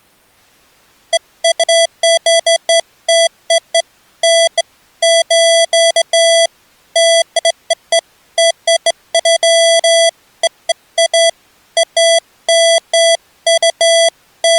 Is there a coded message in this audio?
No, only beeps of irregular length.